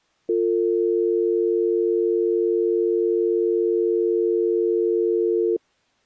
Telephone call progress tone (North American or UK plan), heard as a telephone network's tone, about 350, 450 Hz. Dial tone.